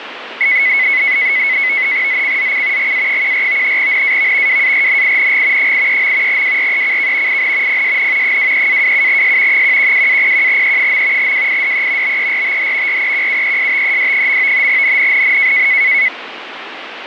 NAVTEX (SITOR-B), 100 baud, 170 Hz shift, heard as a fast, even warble, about 2100 Hz centre, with radio static. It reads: ZCZC GA14 NAV WARNING 83. WRECK IN PSN 23-27S 112-01E. WIDE BERTH REQUESTED. NNNN